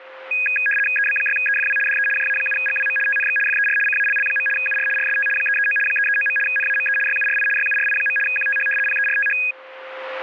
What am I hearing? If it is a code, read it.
RTTY (75 baud, 850 Hz shift), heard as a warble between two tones, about 2050 Hz centre, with a steady whistle near 520 Hz. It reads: EB6EFW DE JA7GWM TNX FER CALL. UR RST 339 339. NAME YURI YURI. QTH PERTH